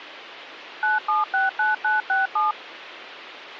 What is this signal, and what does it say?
DTMF, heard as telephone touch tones, dialled by machine, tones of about 160 ms. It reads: 9769967